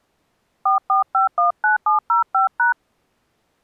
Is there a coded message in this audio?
Yes: DTMF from 0.7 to 2.7 s, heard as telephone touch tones, dialled by hand, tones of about 130 ms. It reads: 44519705#